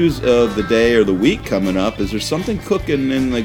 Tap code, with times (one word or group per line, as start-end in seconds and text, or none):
none